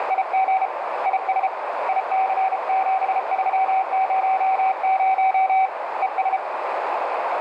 Morse code, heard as a keyed tone, hand-sent with a bug key, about 33 wpm, 760 Hz, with heavy radio static and a narrow filter. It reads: … IS IC7300 ES